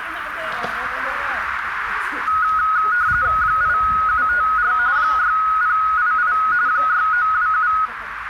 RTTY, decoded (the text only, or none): 8754 6088 6927